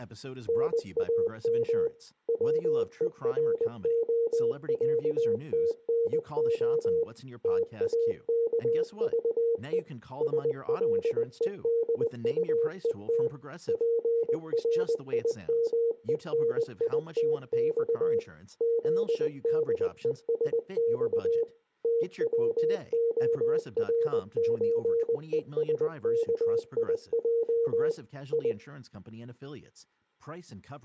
Morse code (Russian alphabet), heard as a keyed tone, machine-sent, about 20 wpm, 460 Hz, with speech in English. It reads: НАМ ВЕРОЯТНО ТАКЖЕ СЛЕДУЕТ ПРИМЕНИТЬ ЗДЕСЬ ТВОРЧЕСКИЙ И